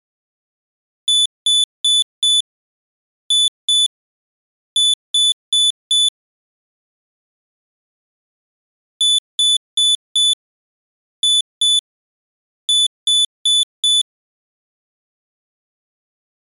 Beep code, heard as a piezo beeper, played twice, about 3500 Hz. 4-2-4. In Phoenix BIOS tables: unexpected interrupt in protected mode.